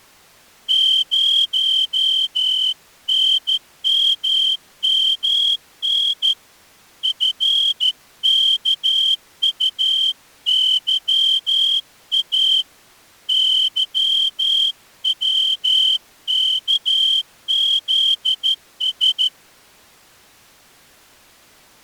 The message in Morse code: 0NMMN FKUYA YWKZS

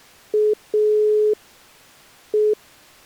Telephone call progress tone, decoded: dial tone

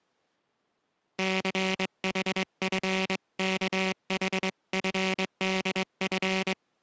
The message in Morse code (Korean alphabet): 춘우는

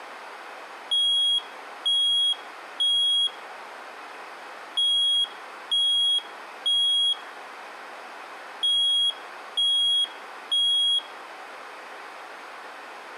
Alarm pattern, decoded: temporal three

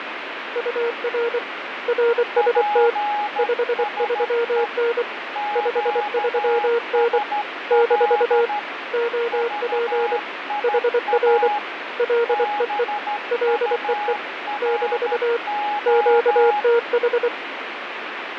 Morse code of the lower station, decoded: UR RST 53N 53N - OP HR LEE LEE - QTH

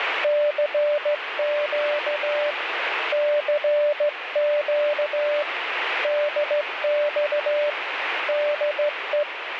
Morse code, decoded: CQ CQ DX DE

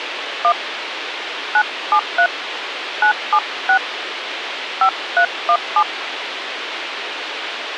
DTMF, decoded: 1 973 976 5317

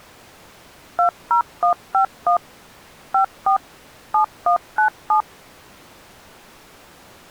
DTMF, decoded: 20151 54 7197

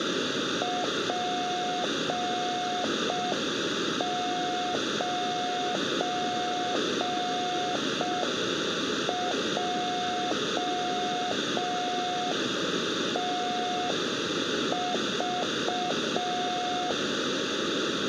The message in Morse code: P9JTV

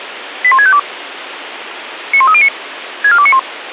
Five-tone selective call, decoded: 81652 91309 64291

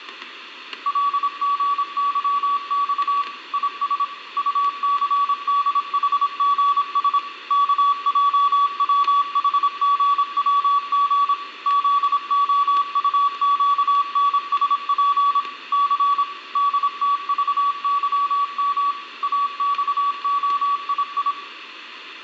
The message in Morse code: LGYX IS UCDHGS KJWHGWG ZOUQNSP C DTVYM AXOII

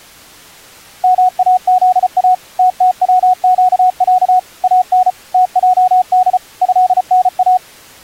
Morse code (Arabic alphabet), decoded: ماذا تتوقع ان تجد هنا

